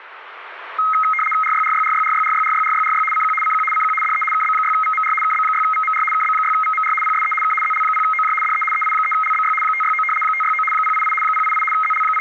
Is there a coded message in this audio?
Yes: RTTY (75 baud, 850 Hz shift) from 0.8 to 12.2 s, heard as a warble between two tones, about 1700 Hz centre, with radio static. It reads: RYRYRYRYRYRYRYRY CQ CQ CQ DE KB6VMR KB6VMR KB6VMR PSE K ZL0OJ DE EI3LBY 569 569 088 088 …